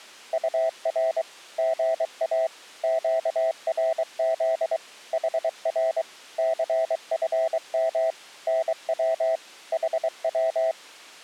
Morse code, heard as a keyed tone, machine-sent, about 23 wpm, 650 Hz. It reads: UR GA QRZ HR CFM NW HW